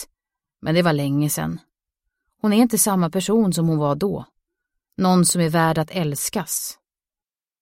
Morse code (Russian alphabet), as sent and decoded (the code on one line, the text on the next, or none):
none